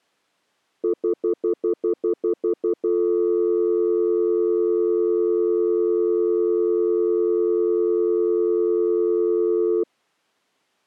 Telephone call progress tone (North American plan), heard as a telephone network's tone, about 350, 440 Hz, 0.1 s on and 0.1 s off. Stutter dial tone.